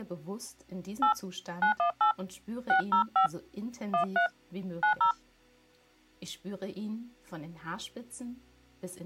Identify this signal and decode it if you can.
DTMF, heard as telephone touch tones, dialled by hand, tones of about 100 ms. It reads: 8 918 605 13 90